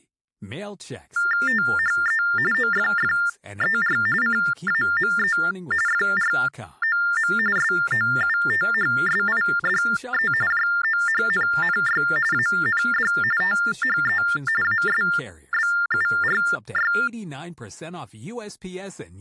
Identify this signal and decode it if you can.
TTY/TDD text telephone tones (45.45 baud Baudot), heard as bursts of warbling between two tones, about 400 Hz shift, 1600 Hz centre, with speech in English. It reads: THE OFFER CAME FROM SOUTHSIDE JOHNNY AND THE ASBURY